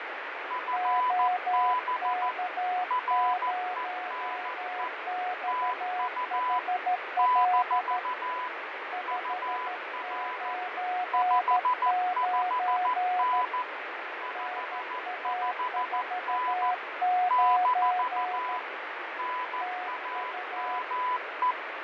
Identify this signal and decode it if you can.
Morse code, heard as two keyed tones, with heavy radio static and fading. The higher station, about 14 wpm, 1000 Hz: FB RENE TU - UR 55N 55N - NAME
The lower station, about 13 wpm, 730 Hz: OK0XHL 599 NA49 TU